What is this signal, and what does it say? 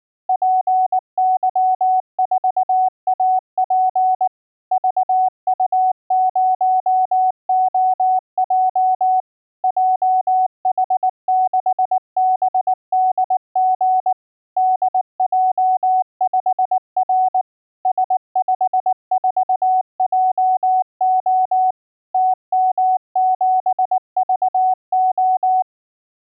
Morse code, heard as a keyed tone, machine-sent, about 19 wpm, 750 Hz. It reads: PY4AP VU0OJ JH6BDG DJ5R S54JO TM7VO